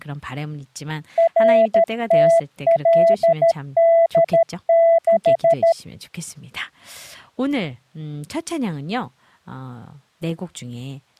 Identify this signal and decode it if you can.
Morse code, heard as a keyed tone, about 13 wpm, 670 Hz, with speech in Korean. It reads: RTLD6